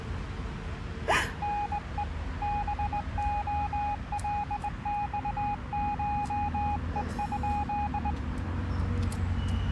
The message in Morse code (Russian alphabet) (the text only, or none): НЕ БОЛЬШЕ?